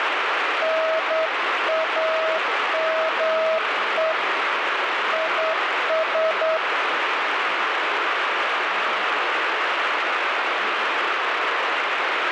Morse code, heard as a keyed tone, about 9 wpm, 640 Hz, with heavy radio static. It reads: NAME IS